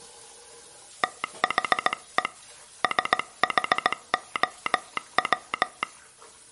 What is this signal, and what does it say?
Morse code, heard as a telegraph sounder, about 17 wpm, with kitchen noise. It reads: THE SHOW